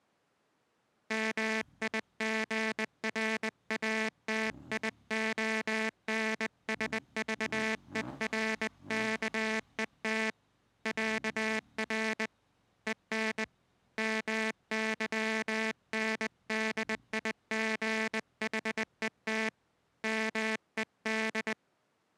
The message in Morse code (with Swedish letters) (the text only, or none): MIGRATIONSVERKET ÄR EN MYNDIGHET MED